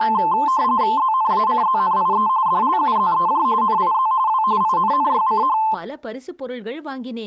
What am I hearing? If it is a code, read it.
RTTY (45.45 baud, 170 Hz shift), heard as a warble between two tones, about 960 Hz centre, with speech in Tamil. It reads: ZNACZNIE DLUZEJ NIZ W INNYCH